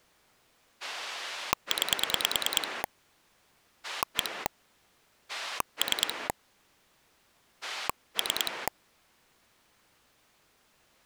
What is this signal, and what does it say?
Pulse dialling, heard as a rotary dial, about 9 pulses a second. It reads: 9 1 3 3